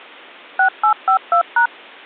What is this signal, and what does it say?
DTMF, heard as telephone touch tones, dialled by machine, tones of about 100 ms. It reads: 6852#